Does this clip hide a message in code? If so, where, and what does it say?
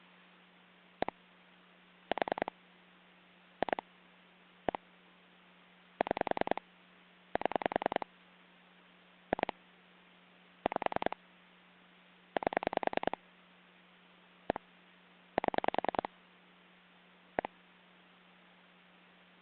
Yes: pulse dialling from 1.0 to 17.5 s, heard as clicks on a phone line, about 10 pulses a second, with hum. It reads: 1 4 2 1 6 7 2 5 8 1 7 1